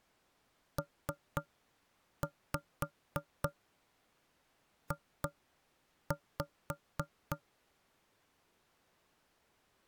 Tap code, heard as knocks on wood, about 3 knocks a second. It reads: PJ